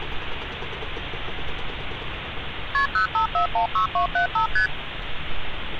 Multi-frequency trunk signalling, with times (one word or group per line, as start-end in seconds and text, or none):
2.7-2.9 KP
2.9-4.5 05416275
4.6-4.7 ST